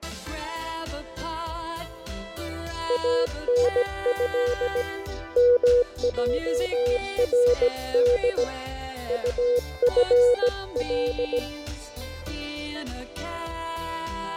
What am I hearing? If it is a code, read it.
Morse code (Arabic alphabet), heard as a keyed tone, hand-sent with a bug key, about 17 wpm, 490 Hz, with fading and static crashes. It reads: انه مجرد طفل